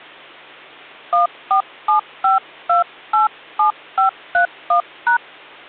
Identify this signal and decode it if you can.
DTMF, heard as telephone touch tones, dialled by hand, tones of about 120 ms, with hum. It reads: 1475287531#